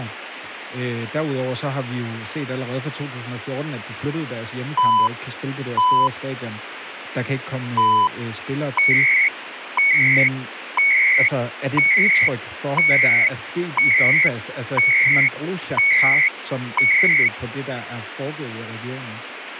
Radio time signal (CHU, Canada), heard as beeps and data bursts, one a second, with radio static and speech in Danish.